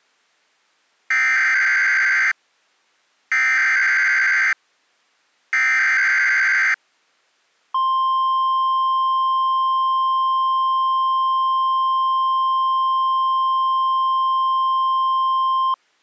Emergency Alert System (SAME) tones (header bursts, then the 1050 Hz attention tone), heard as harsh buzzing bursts, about 520.83 baud.